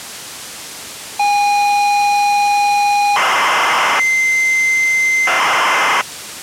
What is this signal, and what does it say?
ZX Spectrum tape loading, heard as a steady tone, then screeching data.